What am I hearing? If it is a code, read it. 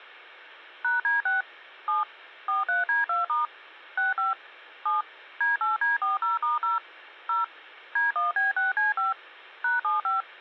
DTMF, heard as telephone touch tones, dialled by machine, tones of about 150 ms. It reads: #D6 7 43D2* 65 7 D8D40*0 0 D1B6C5 #75